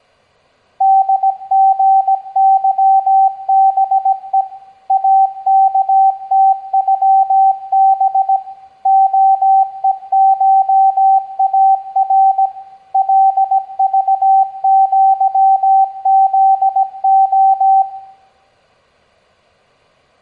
Morse code (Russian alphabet), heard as a keyed tone, machine-sent, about 17 wpm, 770 Hz, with room echo. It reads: ДГЫБЕ АКТЮБ ОЕШАР ЛЖЪЗО